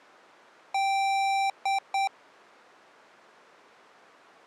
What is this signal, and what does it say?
Beep code, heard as beeps from a small speaker, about 780 Hz. 1 long, 2 short. In Award, IBM and AMI BIOS tables: video adapter failure.